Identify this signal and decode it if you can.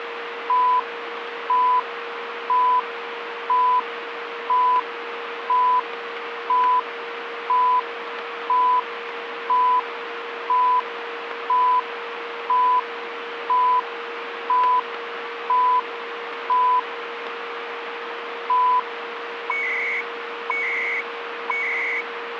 Radio time signal (CHU, Canada), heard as beeps and data bursts, one a second, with radio static and a steady whistle near 470 Hz.